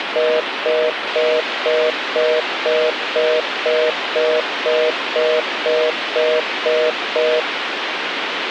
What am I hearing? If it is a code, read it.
Telephone call progress tone (North American plan), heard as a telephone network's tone, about 480, 620 Hz, 0.25 s on and 0.25 s off, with phone line noise. Congestion tone.